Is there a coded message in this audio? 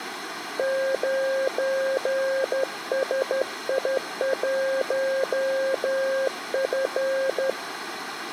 Yes: Morse code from 0.5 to 7.6 s, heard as a keyed tone, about 12 wpm, 540 Hz, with room echo. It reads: 9SI1F